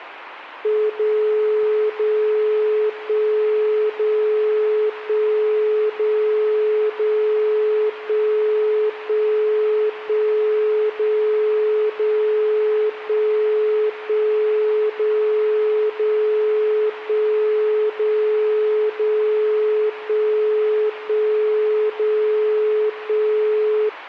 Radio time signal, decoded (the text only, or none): 0 0 1 0 1 0 0 1 1 1 0 0 1 1 0 0 1 0 0 1 1 0 1